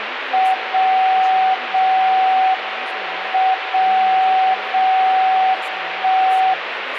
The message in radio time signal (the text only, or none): 0 0 M 0 0 1